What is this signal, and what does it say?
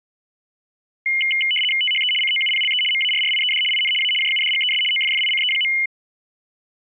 RTTY (75 baud, 850 Hz shift), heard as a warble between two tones, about 2550 Hz centre. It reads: THE COUPLE MARRIED IN A JUDGES OFFICE.